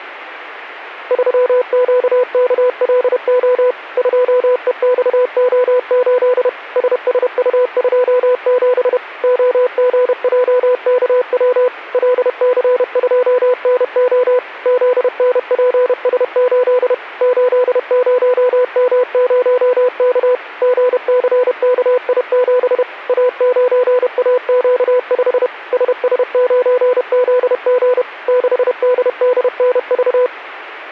Morse code, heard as a keyed tone, machine-sent, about 31 wpm, 500 Hz. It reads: 3QKLO 2EXO8 SSU27 OGJKW LC2NO ZNPS8 80M0K GCKI7 A9AQ5 SS9ZG 6DDNV